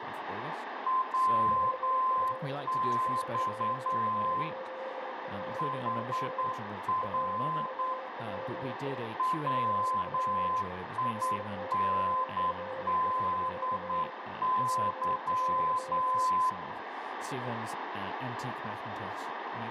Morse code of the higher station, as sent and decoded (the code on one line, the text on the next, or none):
.-- -..- / .... .-. / .-- .. -. -.. -.--
WX HR WINDY